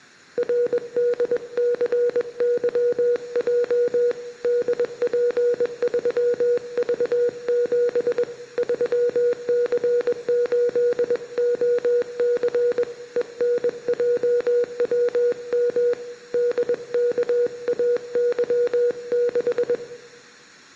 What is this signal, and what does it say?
Morse code, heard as a keyed tone, hand-sent with a paddle, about 21 wpm, 480 Hz, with room echo. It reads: RDCYJ DP3V7 3C8OC ENJWM DKAY6